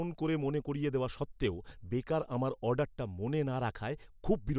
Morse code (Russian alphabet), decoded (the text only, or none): none